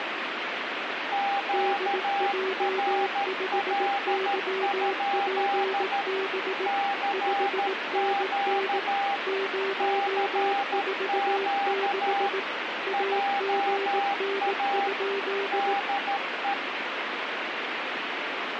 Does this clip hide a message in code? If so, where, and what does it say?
Yes: Morse code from 1.1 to 16.6 s, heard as two keyed tones, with radio static. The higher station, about 13 wpm, 800 Hz: QRL? CQ CQ JA DE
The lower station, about 18 wpm, 390 Hz: DJ5YPB 5NN 046 AGN?